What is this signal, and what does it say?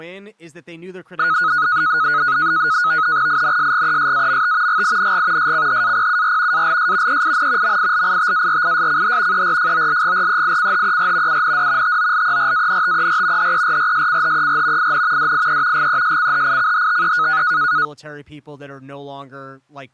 NAVTEX (SITOR-B), 100 baud, 170 Hz shift, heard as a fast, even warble, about 1360 Hz centre, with speech in English. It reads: INSGESAMT GING SCHAPUR ALS EIN MILITARISCH ERFOLGREICHER UND TOLERANTER HERRSCHER IN DIE GESCHICHTE